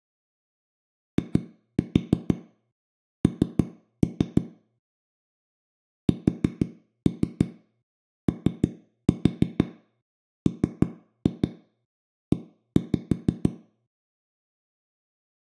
Tap code, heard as knocks on a wall, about 6 knocks a second, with room echo. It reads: IN SOME